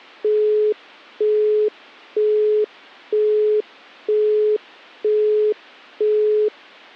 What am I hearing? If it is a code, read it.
Telephone call progress tone (single-tone plan, as in Europe, Japan and elsewhere), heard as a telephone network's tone, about 420 Hz, 0.48 s on and 0.48 s off. Busy tone.